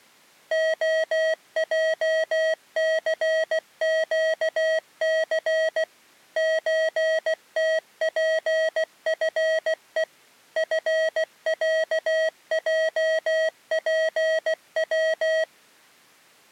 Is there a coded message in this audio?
Yes: Morse code (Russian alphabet) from 0.5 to 15.5 s, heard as electronic beeps, machine-sent, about 16 wpm, 640 Hz. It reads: ОЙЦЩЦ ЧТПФЕ ФЯЙПВ